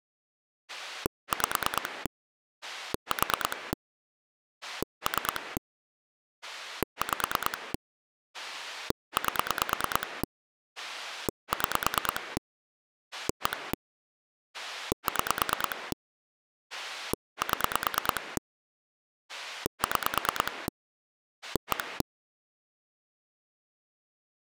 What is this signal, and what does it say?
Pulse dialling, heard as a rotary dial, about 9 pulses a second. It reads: 5 4 3 5 8 6 1 6 7 6 1